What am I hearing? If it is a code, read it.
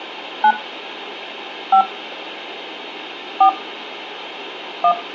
DTMF, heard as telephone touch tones, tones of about 90 ms, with hum and room echo. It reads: 9 5 4 1